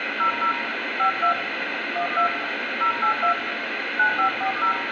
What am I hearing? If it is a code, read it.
DTMF, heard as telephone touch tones, dialled by hand, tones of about 100 ms, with radio hiss and room echo. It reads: 00 52 12 082 9540